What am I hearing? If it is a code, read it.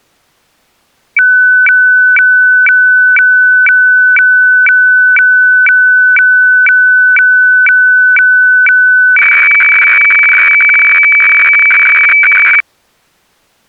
Weather fax (radiofax), 120 lines a minute, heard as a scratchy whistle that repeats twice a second.